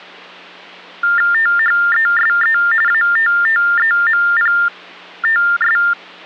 TTY/TDD text telephone tones (45.45 baud Baudot), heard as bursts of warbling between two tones, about 400 Hz shift, 1600 Hz centre, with hum. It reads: THESE ATTEMPTS